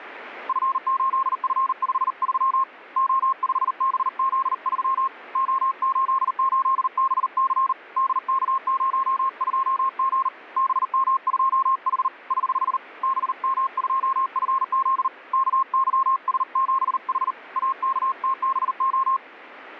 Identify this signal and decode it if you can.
Morse code, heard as a keyed tone, hand-sent with a paddle, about 39 wpm, 1060 Hz, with radio static. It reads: F8F53 O5BZ3 O88BC DK02G BM2H <HH> BM2FZ KYS7H AKTBO